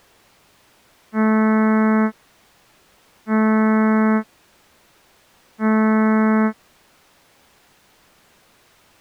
Ship horn signal, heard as a ship's horn, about 220 Hz. 3 short. At sea: I am operating astern propulsion.